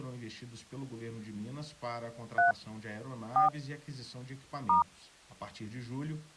DTMF, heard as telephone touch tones, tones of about 130 ms. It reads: 3 4 *